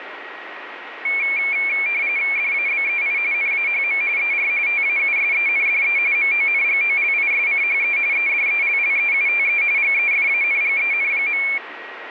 RTTY (45.45 baud, 170 Hz shift), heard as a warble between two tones, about 2300 Hz centre, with radio static and a steady whistle near 1900 Hz. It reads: DABEI NAHM ER TAUSENDE MONGOLISCHE EDELLEUTE GEFANGEN.